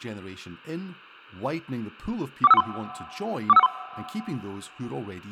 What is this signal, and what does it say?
Five-tone selective call (EIA), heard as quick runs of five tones, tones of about 30 ms, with speech in English. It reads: 41513 41513